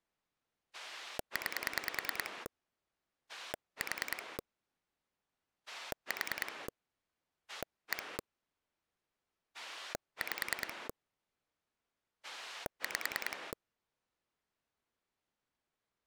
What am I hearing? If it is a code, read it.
Pulse dialling, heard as a rotary dial, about 10 pulses a second. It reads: 9 4 4 1 5 5